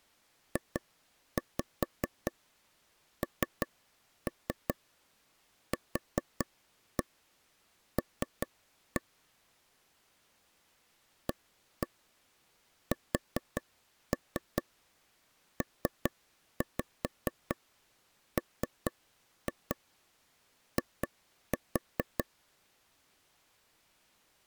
Tap code, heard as taps on a table, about 4 knocks a second. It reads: JNQL ASPMI